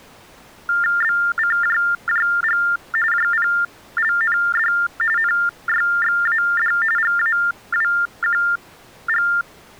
TTY/TDD text telephone tones (45.45 baud Baudot), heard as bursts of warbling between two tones, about 400 Hz shift, 1600 Hz centre. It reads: BCJJG JPLND NYXAD GAWQG